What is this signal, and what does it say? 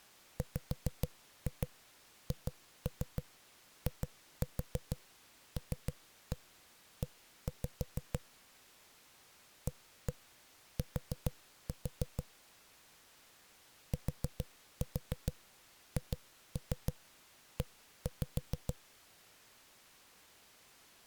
Tap code, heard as knocks on a wall, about 6 knocks a second. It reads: WHILE AT THE